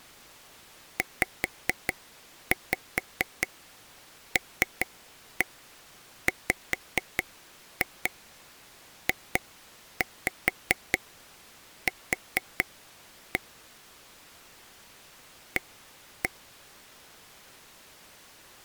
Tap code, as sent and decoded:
5-5 3-1 5-2 2-5 4-1 / 1-1
ZLWJQ A

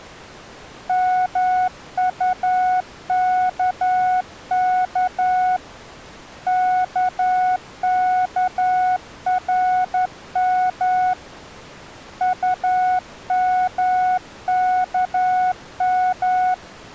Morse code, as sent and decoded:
-- ..- -.- -.- / -.- -.- .-. -- / ..- -- -.- --
MUKK KKRM UMKM

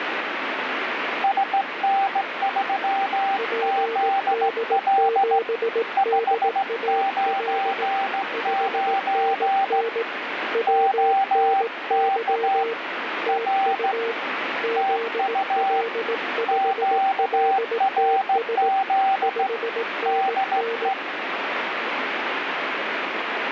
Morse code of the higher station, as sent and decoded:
... -. ...-- --.. .-.. / ..... ----. ----. / --- -.- / .-. / - ..- / --.- .-. --.. / -.. .
SN3ZL 599 OK R TU QRZ DE

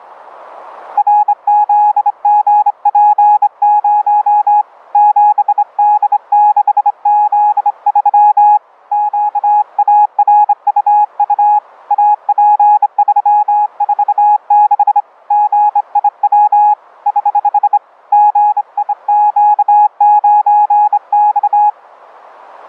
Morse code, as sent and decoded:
.-. --.. --. .--. ----- / --... -.. -.... --.. ...-- / --.- .- .-. ..- ..- / .- .--. ...-- ....- -.... / --. .. .-- / ........ / --. .. --.- ----. -..-
RZGP0 7D6Z3 QARUU AP346 GIW <HH> GIQ9X

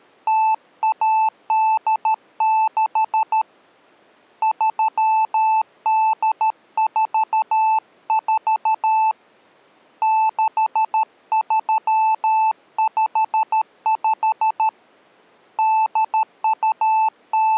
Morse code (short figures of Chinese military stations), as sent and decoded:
- .- -.. -.... / ...-- -.. ....- ....- / -.... ...-- ..... ..... / …
0186 3844 6355 …

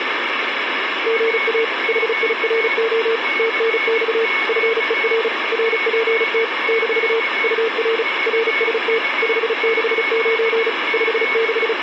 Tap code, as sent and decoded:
none

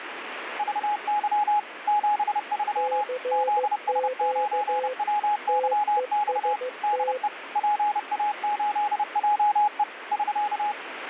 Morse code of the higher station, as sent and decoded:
...- -.-- / --... ...-- / --.. ... ----. .-- -.-- -..- / -.. . / .--. .- ---.. .--- . / ...-.-
VY 73 ZS9WYX DE PA8JE <SK>

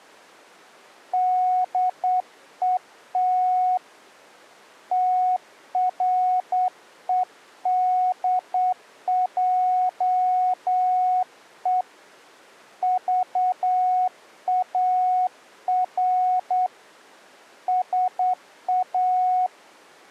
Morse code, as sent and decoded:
-.. . - / - .-. . -.. .--- . / ...- .- .-. / ... .-
DET TREDJE VAR SA

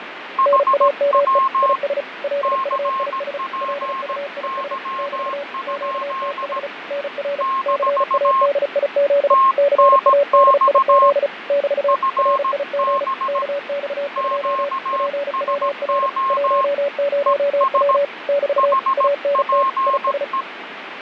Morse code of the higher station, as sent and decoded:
.... .-- / -.-. .--. -.-- ..--.. / -....- / - -. -..- / ..-. -... / --.- ... --- / . ... / .... .--. .
HW CPY? - TNX FB QSO ES HPE

